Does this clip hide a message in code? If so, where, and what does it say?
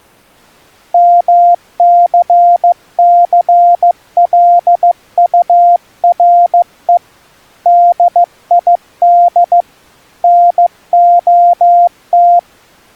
Yes: Morse code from 0.9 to 12.5 s, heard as a keyed tone, hand-sent with a paddle, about 15 wpm, 700 Hz. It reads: MCCLURE DID NOT